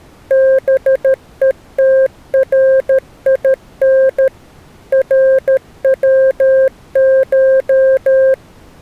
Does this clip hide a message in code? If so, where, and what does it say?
Yes: Morse code (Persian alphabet) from 0.2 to 8.4 s, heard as a keyed tone, machine-sent, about 13 wpm, 530 Hz. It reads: بهترین روش